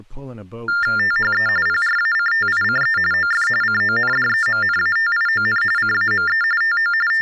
TTY/TDD text telephone tones (45.45 baud Baudot), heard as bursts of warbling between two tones, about 400 Hz shift, 1600 Hz centre, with speech in English. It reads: THE PRACTICE OF CONDEMNATION CAME TO …